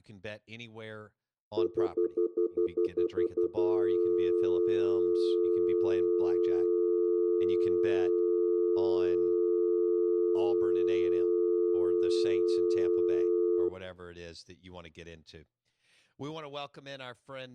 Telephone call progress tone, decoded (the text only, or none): stutter dial tone